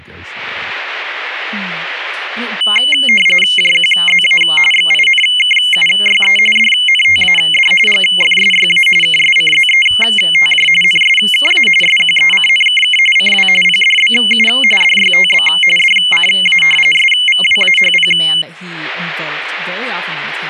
RTTY (45.45 baud, 850 Hz shift), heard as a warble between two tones, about 2550 Hz centre, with speech in English. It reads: JQZA XINKUYE DNTAD GFSYA KSCZETJ NSKA SQECNKK CW PDBU DYTB DCA SVWAHP